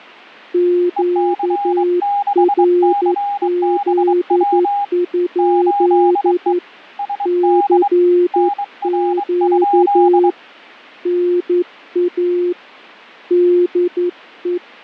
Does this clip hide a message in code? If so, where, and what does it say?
Yes: Morse code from 0.5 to 14.6 s, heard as two keyed tones. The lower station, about 11 wpm, 350 Hz: QRZ? CQ NA DE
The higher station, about 23 wpm, 810 Hz: EC6CBW 8E SD NR?